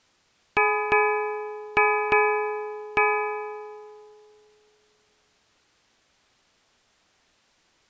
Ship's bell, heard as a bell. 5. Five half-hours of the watch have passed.